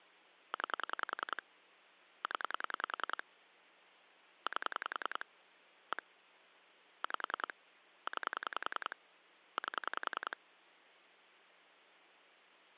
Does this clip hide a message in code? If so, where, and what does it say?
Yes: pulse dialling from 0.5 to 10.3 s, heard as clicks on a phone line, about 10 pulses a second. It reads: 9 0 8 1 5 9 8